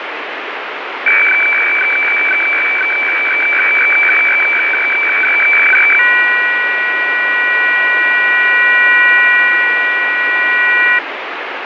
Weather fax (radiofax), 120 lines a minute, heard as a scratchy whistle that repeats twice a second, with radio static.